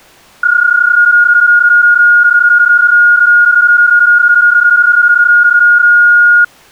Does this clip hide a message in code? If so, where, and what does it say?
Yes: PSK31 (31.25 baud) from 0.4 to 6.4 s, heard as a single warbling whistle, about 1430 Hz.